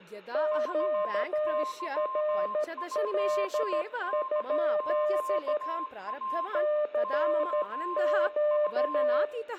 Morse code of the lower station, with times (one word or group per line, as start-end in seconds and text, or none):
0.3-5.6 QRL?
6.5-9.2 CQ